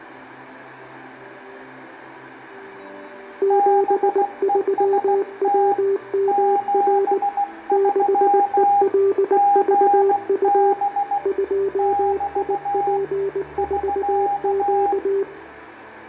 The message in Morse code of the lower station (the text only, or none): 73WMR 6ELVU 2IP4Q